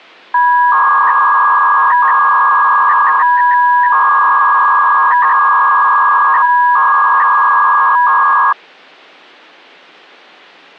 300-baud modem data (V.21 tones), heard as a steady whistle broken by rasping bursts, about 300 baud, 200 Hz shift.